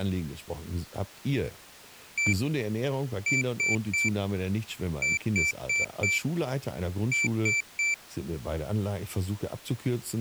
Beep code, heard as a piezo beeper, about 2350 Hz, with speech in German. 1-3-4-3. In Phoenix BIOS tables: memory failure on data bits.